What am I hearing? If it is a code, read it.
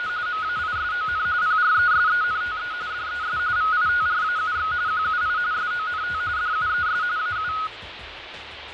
RTTY (45.45 baud, 170 Hz shift), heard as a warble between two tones, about 1360 Hz centre, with radio static and fading. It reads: … MAISON PRESENTE DES VITRAUX QUI SONT DUES AU